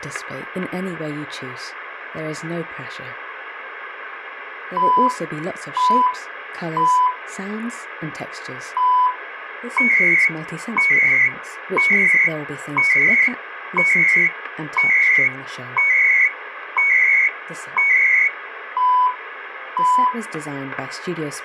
Radio time signal (CHU, Canada), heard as beeps and data bursts, one a second, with radio static and static crashes.